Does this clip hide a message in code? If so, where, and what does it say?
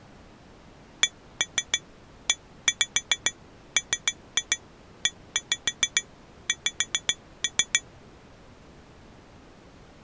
Yes: tap code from 1.0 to 7.8 s, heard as taps on glass, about 6 knocks a second. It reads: CEMEX